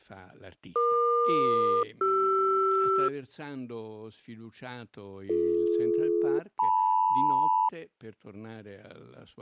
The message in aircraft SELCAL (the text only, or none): EQ-CR BD-LM